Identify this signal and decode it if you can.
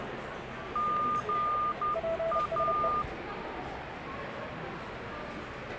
Morse code, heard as two keyed tones, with radio static and the noise of a cafe. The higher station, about 11 wpm, 1210 Hz: GA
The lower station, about 30 wpm, 660 Hz: PSE